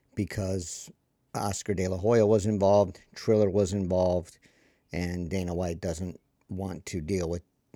Speech in English. There is no code.